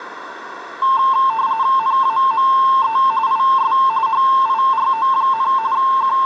RTTY (45.45 baud, 170 Hz shift), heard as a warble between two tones, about 980 Hz centre, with radio static and a narrow filter. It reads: NAME IS HIRO, …